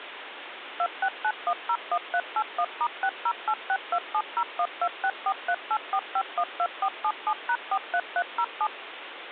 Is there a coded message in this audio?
Yes: DTMF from 0.8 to 8.7 s, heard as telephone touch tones, dialled by machine, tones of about 60 ms, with phone line noise. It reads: 269101381*60862701264384512477#43307